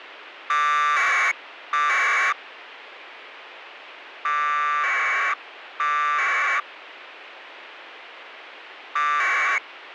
Packet radio (AX.25, as in APRS), 1200 baud, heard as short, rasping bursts, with radio hiss.